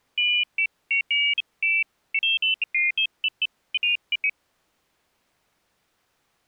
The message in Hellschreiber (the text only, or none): none